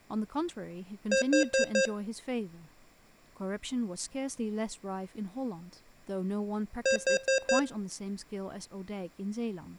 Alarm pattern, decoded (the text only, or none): temporal four